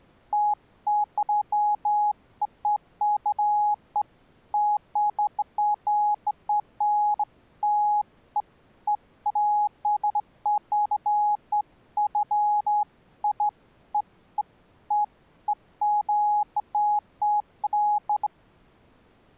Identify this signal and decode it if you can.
Beeps of irregular length. There is no code.